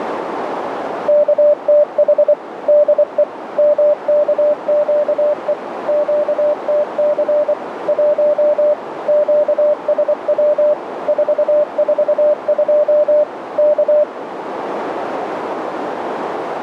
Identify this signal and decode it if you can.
Morse code, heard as a keyed tone, machine-sent, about 24 wpm, 600 Hz, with radio static and a narrow filter. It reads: KTH DE MKQE QTC 1 QSW 442 K